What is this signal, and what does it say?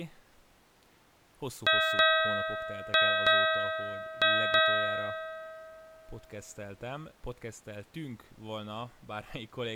Ship's bell, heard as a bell, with speech in Hungarian. 6. Six half-hours of the watch have passed.